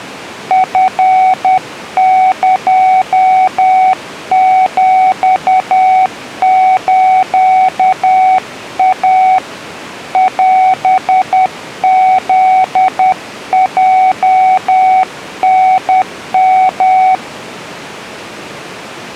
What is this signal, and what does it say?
Morse code (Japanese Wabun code), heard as a keyed tone, hand-sent with a paddle, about 10 wpm, 750 Hz. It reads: チエヒスイ オフヲタヨ